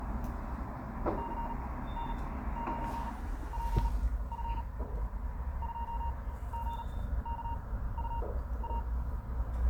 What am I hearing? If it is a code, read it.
Morse code, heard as a keyed tone, machine-sent, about 38 wpm, spaced as for 16 wpm, 930 Hz, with the noise of a residential street. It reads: CN9PF 2GKUA